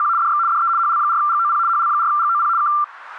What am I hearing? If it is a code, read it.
RTTY (75 baud, 170 Hz shift), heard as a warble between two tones, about 1270 Hz centre. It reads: … DX DE HL4GOP HL4GOP K